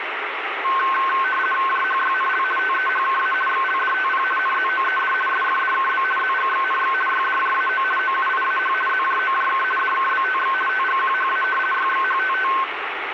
RTTY (50 baud, 450 Hz shift), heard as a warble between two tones, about 1300 Hz centre, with radio static. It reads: JHYNL TEHKA XLDTP NZOED SFDKB ZGXNX YDJAO OUIAH ZJOJK DKBTX TGQHA YXHTT